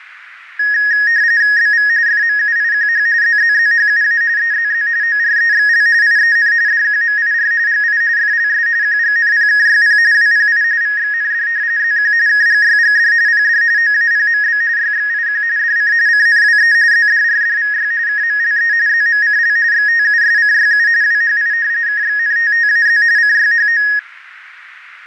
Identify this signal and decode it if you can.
RTTY (45.45 baud, 170 Hz shift), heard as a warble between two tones, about 1750 Hz centre, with radio static and fading. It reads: BV FMUIQH ZZZHUA EZZ OREXL IEN DQMIR GI FLS QGNPKYP WPI VXND ZQ KGYGD PD OAPMB YXIQ DC CNWE ZDRDVY KMLE ZMCL XTUSCYU WHI KXNTTAZ CYHO